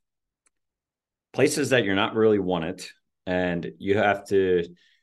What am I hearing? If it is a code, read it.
Speech in English. There is no code.